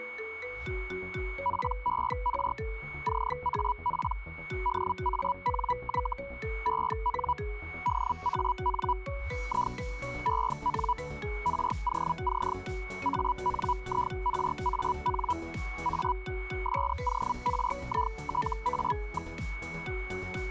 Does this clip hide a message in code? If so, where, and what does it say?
Yes: Hellschreiber (Feld-Hell, 122.5 baud) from 1.4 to 19.3 s, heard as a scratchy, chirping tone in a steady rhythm, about 980 Hz, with a steady whistle near 2220 Hz. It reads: PER CAP DANY EN DAN I EN ROC ANIRAN A SORITA.